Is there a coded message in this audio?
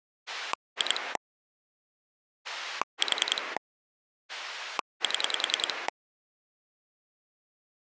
Yes: pulse dialling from 0.3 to 5.9 s, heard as a rotary dial, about 10 pulses a second. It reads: 2 4 7